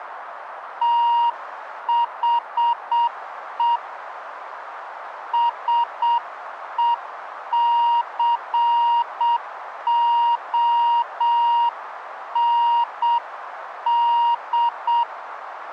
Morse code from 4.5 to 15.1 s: SECOND

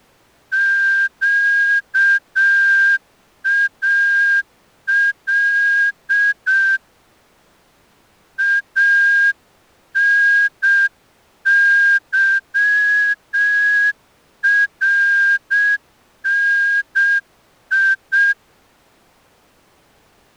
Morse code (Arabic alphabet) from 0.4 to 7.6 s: قال

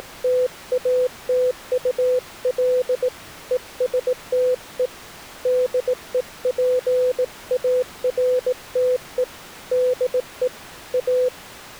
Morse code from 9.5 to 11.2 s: DE A

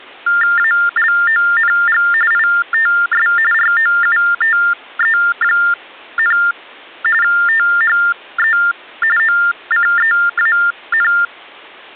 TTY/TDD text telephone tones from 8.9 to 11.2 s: OCEAN

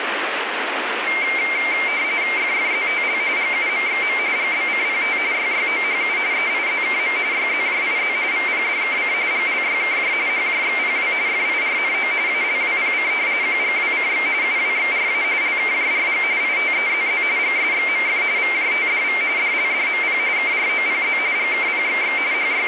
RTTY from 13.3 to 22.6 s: QGWCX UWXRA LKJRG ITEZZ GSXMF VJTDV DLDMP KROPZ GKPXX …

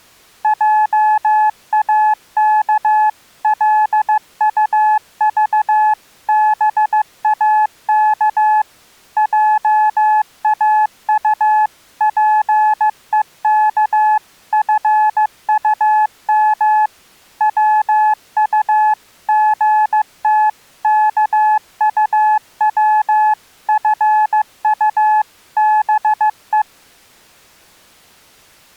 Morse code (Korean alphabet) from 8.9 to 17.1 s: 회장님

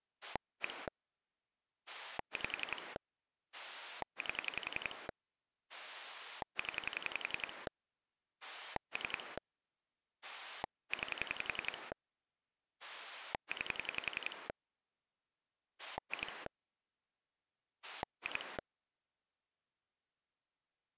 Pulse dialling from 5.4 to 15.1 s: 0 3 9 9

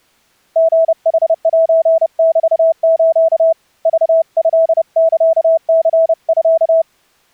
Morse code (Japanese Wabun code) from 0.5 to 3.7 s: リヌセメス

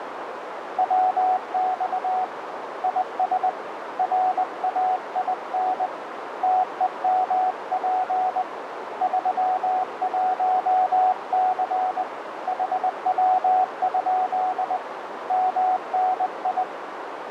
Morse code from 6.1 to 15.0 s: TEMP 31C HW?

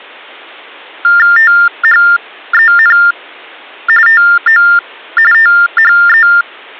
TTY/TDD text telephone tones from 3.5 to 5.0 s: TO

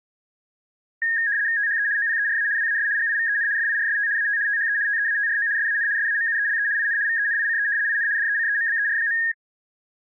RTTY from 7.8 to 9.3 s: IN DECEMBER.

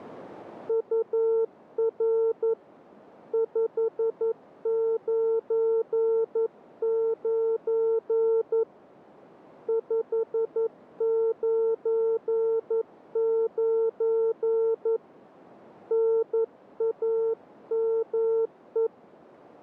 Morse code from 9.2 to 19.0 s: 599 NAME

